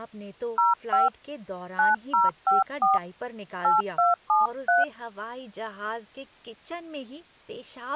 DTMF, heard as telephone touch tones, dialled by hand, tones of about 160 ms, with speech in Hindi. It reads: 05 9054 8273